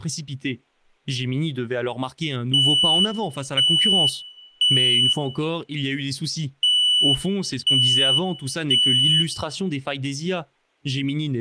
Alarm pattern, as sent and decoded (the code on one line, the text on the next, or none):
3 beeps and a pause
temporal three